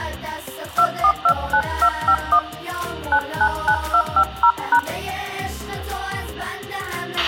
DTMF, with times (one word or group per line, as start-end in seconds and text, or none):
0.8-2.4 2429251
3.1-4.8 999250#